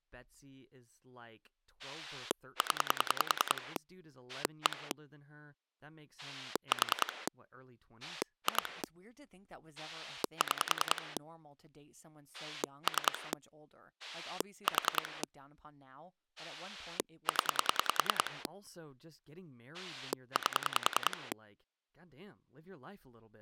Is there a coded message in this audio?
Yes: pulse dialling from 1.8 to 21.3 s, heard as a rotary dial, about 10 pulses a second, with speech in English. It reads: 0 1 4 2 6 3 4 0 8